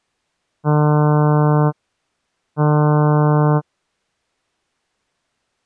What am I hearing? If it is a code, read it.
Ship horn signal, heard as a ship's horn, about 150 Hz. 2 short. At sea: I am altering course to port.